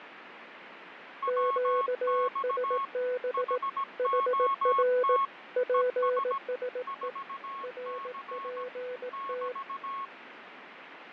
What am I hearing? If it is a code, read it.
Morse code, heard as two keyed tones, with radio static and fading. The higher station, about 17 wpm, 1100 Hz: WX HOT ES 4C <BT>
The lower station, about 18 wpm, 500 Hz: QSB HR PSE RPT